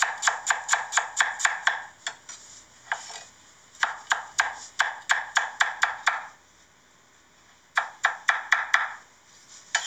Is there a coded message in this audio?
No, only kitchen noise.